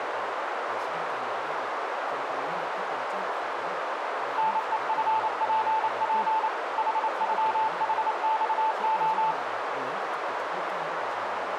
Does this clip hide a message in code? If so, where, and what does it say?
Yes: Morse code (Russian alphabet) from 4.3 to 9.4 s, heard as a keyed tone, machine-sent, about 28 wpm, 880 Hz, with radio static, a narrow filter and speech in Thai. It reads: НЕФПП ХЮХЬО